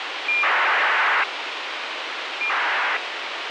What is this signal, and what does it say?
ACARS aircraft data, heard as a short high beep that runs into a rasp, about 2400 baud, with radio hiss.